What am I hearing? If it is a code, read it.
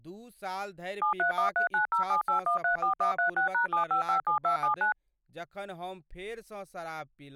DTMF, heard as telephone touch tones, dialled by machine, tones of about 110 ms, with speech in Maithili. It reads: 73139078134136#7557279